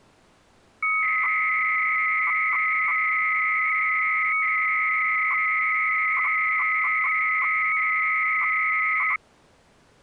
300-baud modem data (Bell 103 tones), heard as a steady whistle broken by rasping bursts, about 300 baud, 200 Hz shift.